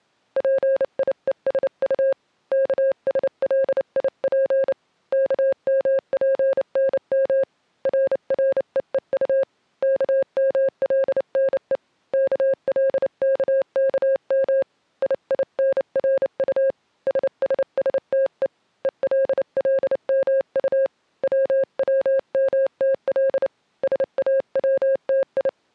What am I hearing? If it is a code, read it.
Morse code, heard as a keyed tone, hand-sent with a paddle, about 29 wpm, 540 Hz. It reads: PIESU KSLIP KMPNM RREEU KMLNE KLKKM IINRU SSSTE ELLMU WWMTL SAWTI